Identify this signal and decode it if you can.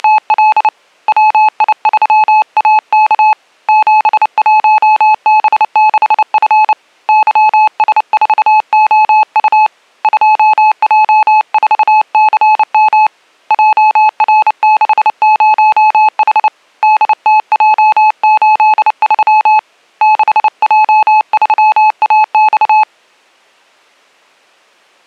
Morse code, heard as a keyed tone, hand-sent with a paddle, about 29 wpm, 860 Hz. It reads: … WI3AK 71B6F YS4OU 2J4CM JR60H DTJ83 6J3AX